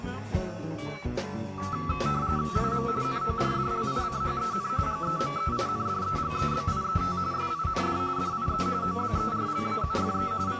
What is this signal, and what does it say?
RTTY (45.45 baud, 170 Hz shift), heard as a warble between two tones, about 1230 Hz centre. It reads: IM NORDLICHEN GEMEINDEGEBIET SIND DIE OBERLAUFE …